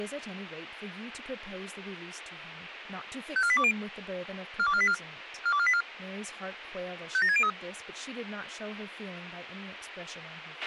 Five-tone selective call (ZVEI), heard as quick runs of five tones, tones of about 70 ms, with radio hiss, a squelch burst at the end and speech in English. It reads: 54820 42484 42484 57603